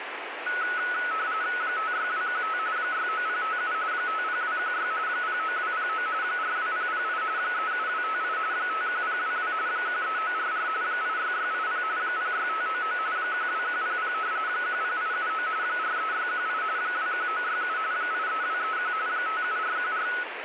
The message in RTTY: 56215 69057 50216 09209 42008 37258 51022 13944 86680 06599 12100 10879 43618 21967 83231 57414

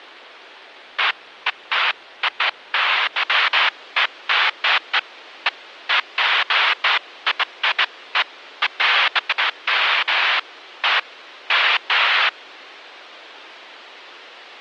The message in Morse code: none

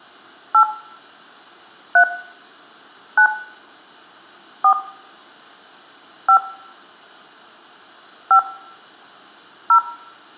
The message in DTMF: 8 3 9 4 5 5 0

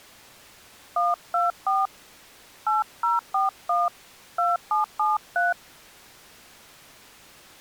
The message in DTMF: 124 8041 2773

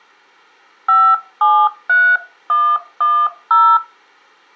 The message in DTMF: 573110

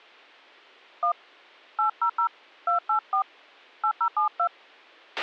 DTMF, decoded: 1 800 284 8072

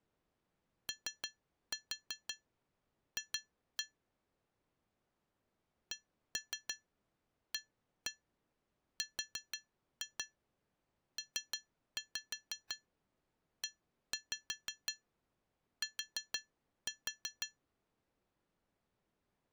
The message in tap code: OF CARPET

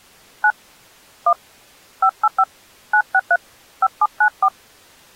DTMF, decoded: 9 1 585 963 5794

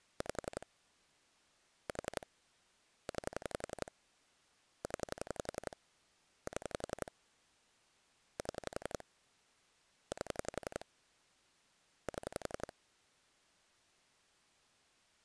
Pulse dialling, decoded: 5 4 9 0 7 7 8 7

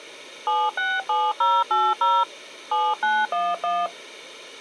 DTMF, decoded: 767080 7911

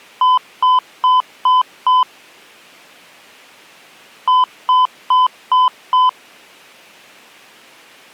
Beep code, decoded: 5 short

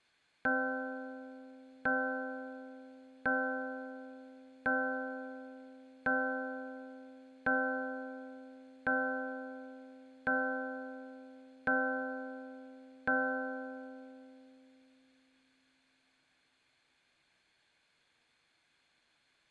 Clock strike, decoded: 10

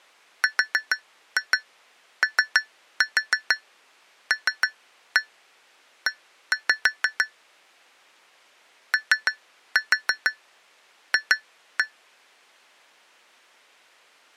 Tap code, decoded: ROLE OF

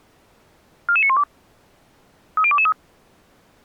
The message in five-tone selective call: 44912 30223

